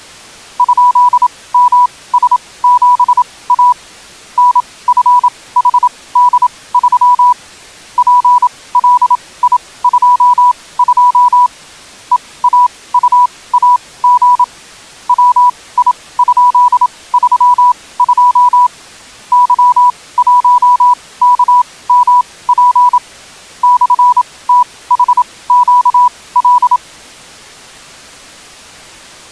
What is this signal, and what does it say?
Morse code, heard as a keyed tone, machine-sent, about 27 wpm, spaced as for 19 wpm, 980 Hz. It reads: ?MS7A NFHD3 PLI22 EAUAG WI?32 Y1KMP /THQL